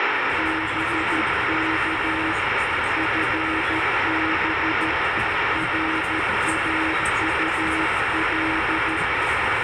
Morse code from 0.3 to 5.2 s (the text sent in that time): BK FB